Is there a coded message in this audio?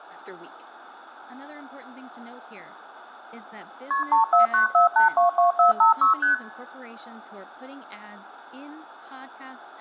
Yes: multi-frequency trunk signalling (R1, as on North American trunks) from 3.9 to 6.3 s, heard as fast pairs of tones, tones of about 130 ms, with speech in English. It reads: KP 3494822456 ST